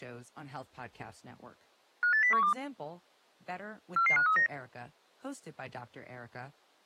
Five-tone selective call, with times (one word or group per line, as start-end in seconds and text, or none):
2.0-2.5 58012
4.0-4.5 44539